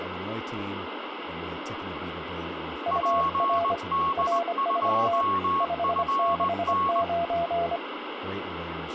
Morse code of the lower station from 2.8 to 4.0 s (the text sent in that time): UR